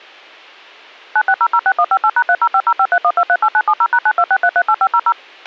DTMF, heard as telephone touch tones, dialled by machine, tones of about 60 ms, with a squelch burst at the end. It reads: 96006158#3050531238970#926338500